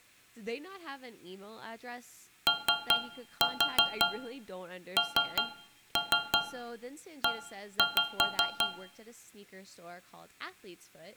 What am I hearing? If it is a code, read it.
Tap code, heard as taps on a metal pipe, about 5 knocks a second, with room echo and speech in English. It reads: ONE